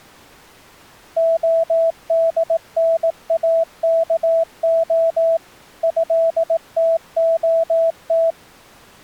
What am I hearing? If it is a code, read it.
Morse code (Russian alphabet), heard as a keyed tone, machine-sent, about 18 wpm, 660 Hz. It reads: ОДНАКО ЭТОТ